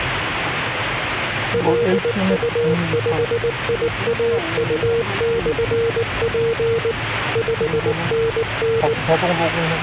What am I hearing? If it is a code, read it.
Morse code, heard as a keyed tone, machine-sent, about 19 wpm, 460 Hz, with radio static and the noise inside a car. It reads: LU5IAU/P 5NN